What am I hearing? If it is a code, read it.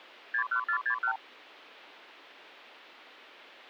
Multi-frequency trunk signalling (R2, with the far end's replies), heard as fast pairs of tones, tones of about 90 ms. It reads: 61461